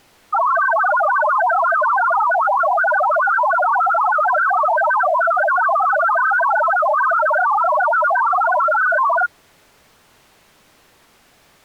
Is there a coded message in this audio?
Yes: multi-tone FSK (Olivia or MFSK type), about 1000 Hz wide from 0.3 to 9.3 s, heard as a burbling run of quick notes, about 62.5 baud.